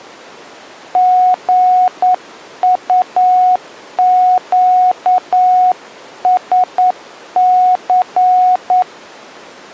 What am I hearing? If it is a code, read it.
Morse code, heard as a keyed tone, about 9 wpm, 730 Hz. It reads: GUQSC